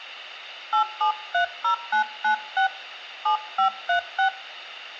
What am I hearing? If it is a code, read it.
DTMF, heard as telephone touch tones, dialled by hand, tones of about 100 ms. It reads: 8730996 7536